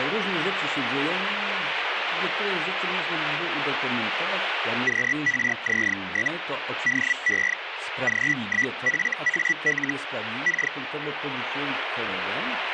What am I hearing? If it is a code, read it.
Hellschreiber (Feld-Hell, 122.5 baud), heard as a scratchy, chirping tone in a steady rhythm, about 1950 Hz, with radio static. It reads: QRZ? DE G1FAL K